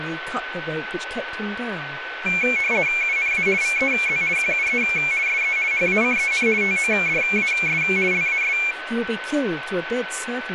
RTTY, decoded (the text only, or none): UNA VEZ QUE SE HACEN TODAS LAS